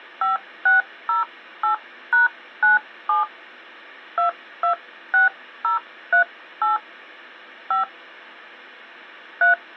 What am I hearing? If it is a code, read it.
DTMF, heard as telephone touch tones, dialled by hand, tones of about 120 ms. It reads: 5608#97 226038 5 3